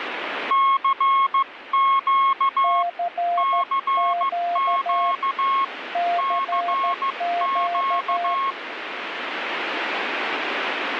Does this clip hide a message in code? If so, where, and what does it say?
Yes: Morse code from 0.4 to 8.6 s, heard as two keyed tones, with radio static. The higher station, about 15 wpm, 1090 Hz: CQ CQ CQ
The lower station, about 13 wpm, 700 Hz: CQ CQ